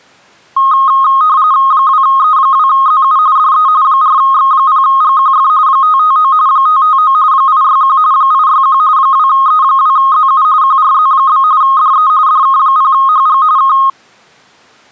RTTY (45.45 baud, 170 Hz shift), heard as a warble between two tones, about 1160 Hz centre. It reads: 2E2ZU DE 4X0GQF 559 559 861 861 2E2ZU QRZ? DE DK0HG K